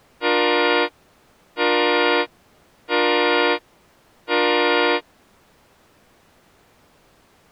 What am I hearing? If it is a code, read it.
Train horn signal, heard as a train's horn. 4 short. On North American railways: a request for a signal to be given or repeated.